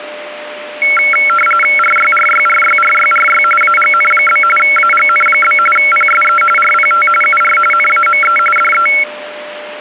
RTTY (45.45 baud, 850 Hz shift), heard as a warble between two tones, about 1800 Hz centre, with radio static and a steady whistle near 600 Hz. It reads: RYRYRYRYRY AGN? AGN? PSE RPT UR NAME DE